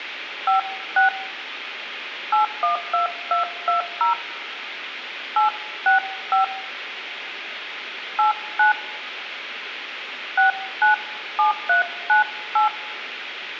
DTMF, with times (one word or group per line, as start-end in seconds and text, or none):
0.5-1.1 56
2.3-4.1 812220
5.4-6.4 865
8.2-8.7 89
10.4-12.7 697398